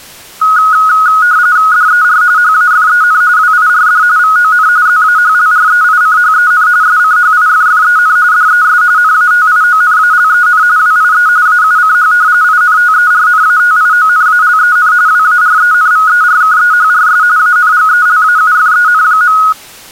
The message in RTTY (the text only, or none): DER HAFEN WIRD VON ZAHLREICHEN SCHIFFEN DES NATIONALEN WIE AUCH INTERNATIONALEN WARENVERKEHRS ANGELAUFEN.